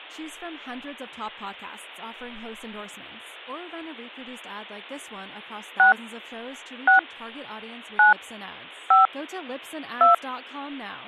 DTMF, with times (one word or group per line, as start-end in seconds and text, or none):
5.8-5.9 6
6.9-7.0 6
8.0-8.1 9
8.9-9.1 5
10.0-10.1 2